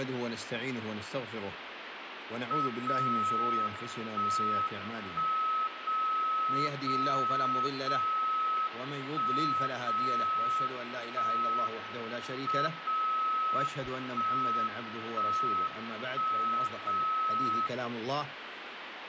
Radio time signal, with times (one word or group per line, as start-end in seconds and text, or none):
2.7-3.7 0
3.7-4.7 1
4.7-5.7 1
5.7-6.7 0
6.7-7.7 0
7.7-8.7 0
8.7-9.7 1
9.7-10.7 0
10.7-11.7 1
11.7-12.7 M
12.7-13.7 0
13.7-14.7 1
14.7-15.7 1
15.7-16.7 1
16.7-17.7 0